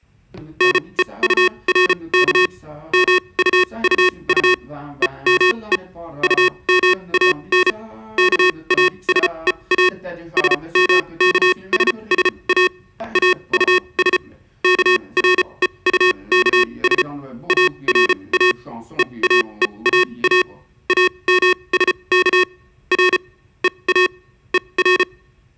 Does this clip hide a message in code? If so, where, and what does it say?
Yes: Morse code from 0.5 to 25.1 s, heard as electronic beeps, machine-sent, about 34 wpm, spaced as for 25 wpm, 360 Hz. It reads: NEURK MUUU EME UMAN KASEA SMKSSA AUS KREUKS ARA EAEAA AMSK R EA ER